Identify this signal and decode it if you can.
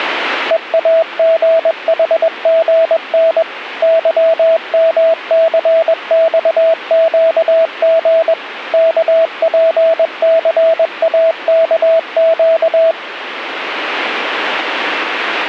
Morse code, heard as a keyed tone, machine-sent, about 21 wpm, 650 Hz. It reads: EAGHGN YMCXQG KPCAKQ